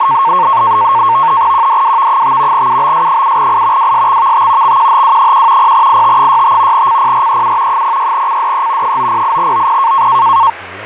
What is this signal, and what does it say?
NAVTEX (SITOR-B), 100 baud, 170 Hz shift, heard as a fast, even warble, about 1000 Hz centre, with radio static and speech in English. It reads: QDWV5 UBS7I WSXVT XQHW1 0IT65 CPREU 06CDE 908OP